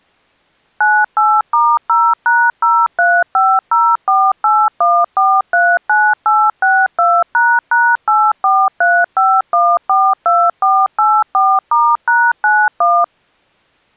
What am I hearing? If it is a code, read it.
DTMF, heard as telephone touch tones, dialled by machine, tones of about 240 ms. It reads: 98*0#0350481439862##8435142484*#91